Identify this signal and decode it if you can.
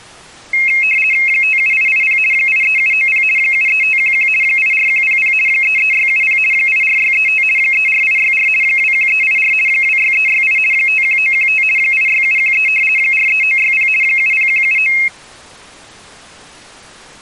RTTY (50 baud, 450 Hz shift), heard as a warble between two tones, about 2350 Hz centre. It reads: 57880 83790 73511 84100 33670 84635 34864 21384 26368 51915 86713 43960 70179